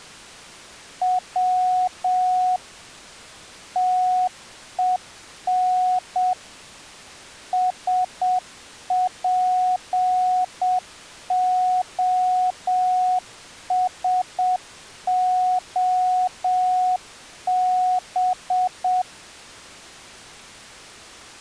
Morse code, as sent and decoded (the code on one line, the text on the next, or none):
.-- / - . -. / ... .--. --- ... --- -...
W TEN SPOSOB